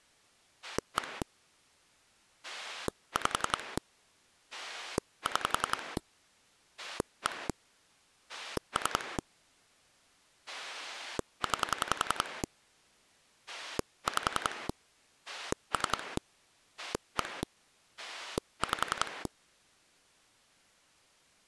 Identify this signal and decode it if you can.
Pulse dialling, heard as a rotary dial, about 11 pulses a second. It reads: 1 5 6 1 3 9 5 3 1 5